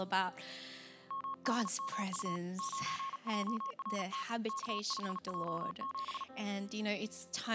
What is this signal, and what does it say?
Morse code, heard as a keyed tone, hand-sent with a paddle, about 38 wpm, 1090 Hz. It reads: MDMU 9JRT K5J7